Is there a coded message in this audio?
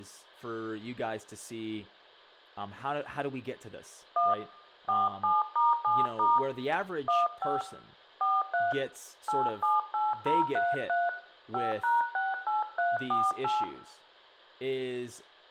Yes: DTMF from 4.2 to 13.6 s, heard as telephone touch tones, dialled by hand, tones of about 180 ms, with room echo and speech in English. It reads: 1 47*7* 15 43 878033 5#68348